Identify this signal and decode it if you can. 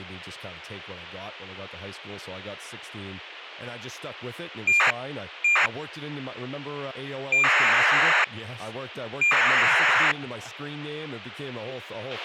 ACARS aircraft data, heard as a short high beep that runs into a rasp, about 2400 baud, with radio hiss, a squelch burst at the end and speech in English.